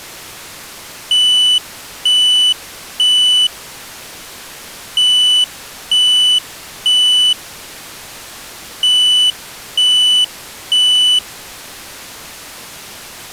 Alarm pattern, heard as an alarm's beeps, played three times, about 3000 Hz. Temporal three. Smoke or fire, evacuate.